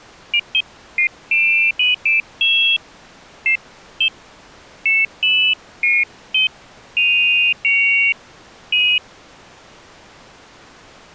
Pairs of high tones at irregular times. There is no code.